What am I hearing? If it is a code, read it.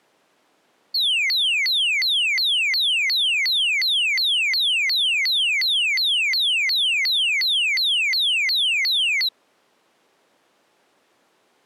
A tone that sweeps in pitch again and again. There is no code.